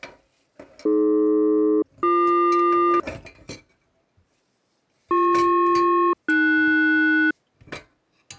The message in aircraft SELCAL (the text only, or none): AD-BQ BP-AS